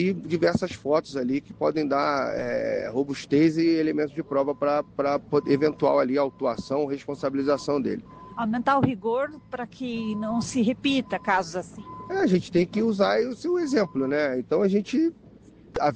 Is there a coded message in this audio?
No.